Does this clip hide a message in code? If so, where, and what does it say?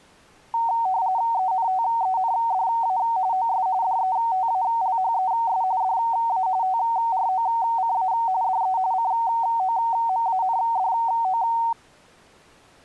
Yes: RTTY (45.45 baud, 170 Hz shift) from 0.5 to 11.7 s, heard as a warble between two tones, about 840 Hz centre. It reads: ENTENDA OS DETALHES DA TROCA DE COMANDO